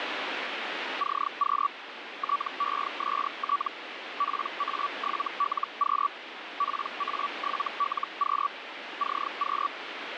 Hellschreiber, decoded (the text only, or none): CQ TEST PA7LQ PA7LQ CQ